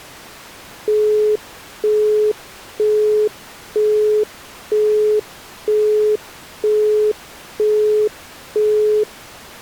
Telephone call progress tone (single-tone plan, as in Europe, Japan and elsewhere), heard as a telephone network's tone, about 420 Hz, 0.48 s on and 0.48 s off. Busy tone.